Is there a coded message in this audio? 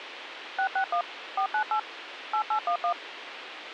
Yes: DTMF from 0.6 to 2.9 s, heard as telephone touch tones, dialled by machine, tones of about 90 ms, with radio hiss. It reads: 661 498 8811